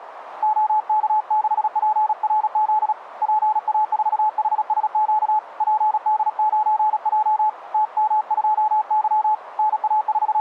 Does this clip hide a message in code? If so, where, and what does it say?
Yes: Morse code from 0.4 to 10.4 s, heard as a keyed tone, hand-sent with a paddle, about 36 wpm, 860 Hz, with radio static. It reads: OK6PRZ PA4HSQ PD9J TM2Y …